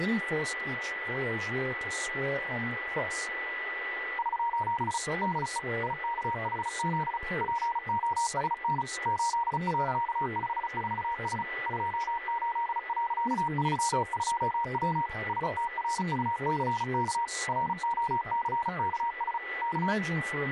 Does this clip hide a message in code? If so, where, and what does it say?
Yes: Morse code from 4.1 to 20.0 s, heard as a keyed tone, machine-sent, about 35 wpm, 940 Hz, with radio static, a steady whistle near 1970 Hz and speech in English. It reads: <SOS> DE IKHZ POSN 8.54S 28.32W STRUCK ROCKS K